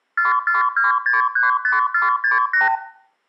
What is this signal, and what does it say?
Multi-frequency trunk signalling (R2, with the far end's replies), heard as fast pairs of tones, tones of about 150 ms, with room echo. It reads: 442635468